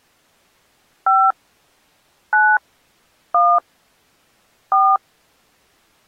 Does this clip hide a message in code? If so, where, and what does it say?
Yes: DTMF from 1.1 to 5.0 s, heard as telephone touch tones, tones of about 240 ms. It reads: 5 9 1 4